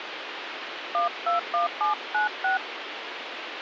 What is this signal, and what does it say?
DTMF, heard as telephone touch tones, dialled by hand, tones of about 130 ms, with phone line noise. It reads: 121796